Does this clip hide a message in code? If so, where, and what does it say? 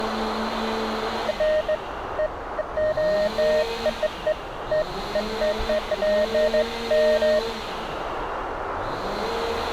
No, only beeps of irregular length, with radio static, a narrow filter and street noise.